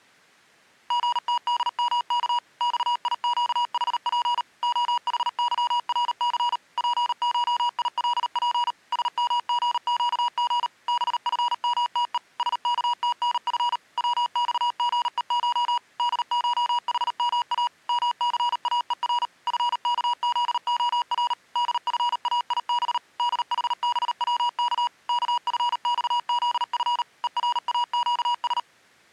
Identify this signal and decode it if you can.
Morse code (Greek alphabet), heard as electronic beeps, machine-sent, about 38 wpm, 960 Hz. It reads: ΓΤΔΜΚ ΞΙΨΗΠ ΟΗΥΡΘ ΠΧΙΛΠ ΣΜΓΨΓ ΒΦΜΤΕ ΣΚΤΝΦ ΩΞΓΕΧ ΔΧΗΜΑ ΜΘΑΕΡ ΦΚΖΟΡ ΔΦΑΙΒ ΔΗΒΩΚ ΚΦΞΖΦ ΕΡΑΨΣ